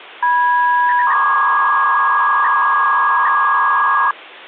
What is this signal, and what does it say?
300-baud modem data (V.21 tones), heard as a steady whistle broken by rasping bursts, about 300 baud, 200 Hz shift.